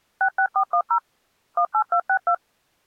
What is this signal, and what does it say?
DTMF, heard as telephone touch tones, dialled by machine, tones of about 80 ms. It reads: 66410 18262